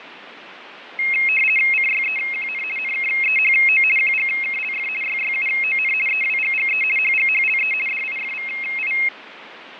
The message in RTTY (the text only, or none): CYEQN NKEHO QGKLF YYUON EWGGE HGHLE DIFVI